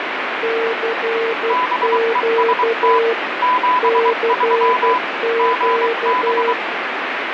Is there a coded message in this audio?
Yes: Morse code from 0.4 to 6.6 s, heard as two keyed tones, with heavy radio static. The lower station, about 12 wpm, 460 Hz: CQ CQ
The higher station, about 23 wpm, 1000 Hz: BEST 73 GB